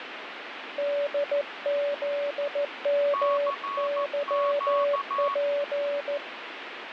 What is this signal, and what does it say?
Morse code, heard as two keyed tones, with radio static. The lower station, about 14 wpm, 570 Hz: DZMYP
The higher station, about 14 wpm, 1110 Hz: CQ